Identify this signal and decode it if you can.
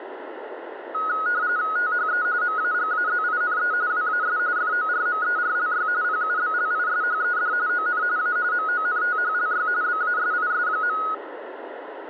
RTTY (45.45 baud, 170 Hz shift), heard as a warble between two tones, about 1360 Hz centre, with radio static. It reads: THE MAGAZINE WAS FORMERLY PUBLISHED ON A MONTHLY BASIS.